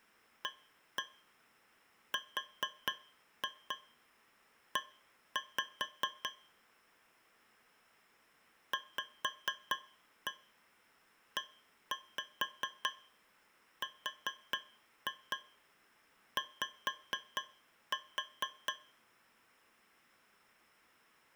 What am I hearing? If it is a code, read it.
Tap code, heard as taps on a metal pipe, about 4 knocks a second. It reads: ARE VERY